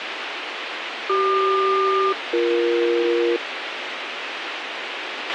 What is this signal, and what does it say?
Aircraft SELCAL, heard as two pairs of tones, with radio hiss and a squelch burst at the end. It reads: CQ-BE